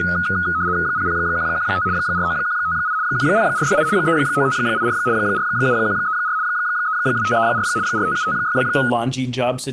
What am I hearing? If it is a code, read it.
RTTY (75 baud, 170 Hz shift), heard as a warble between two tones, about 1360 Hz centre, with speech in English. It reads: 00115 49158 10468 39584 47134 32534 45756